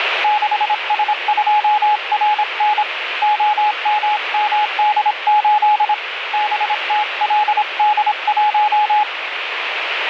Morse code, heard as a keyed tone, hand-sent with a paddle, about 26 wpm, 840 Hz, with radio static. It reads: 6S2RN OMMD8 BTLD1